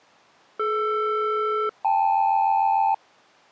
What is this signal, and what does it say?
Aircraft SELCAL, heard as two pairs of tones. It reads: DR-KL